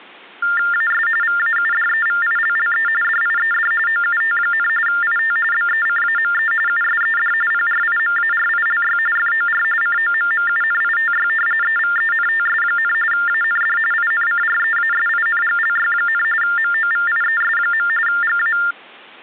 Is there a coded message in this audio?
Yes: TTY/TDD text telephone tones (45.45 baud Baudot) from 0.4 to 18.7 s, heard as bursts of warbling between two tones, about 400 Hz shift, 1600 Hz centre. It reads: AS VAUDEVILLE DIED OUT, IT BECAME USED PRIMARILY FOR COMMUNITY EVENTS, AND INCREASINGLY, MOVIES. GA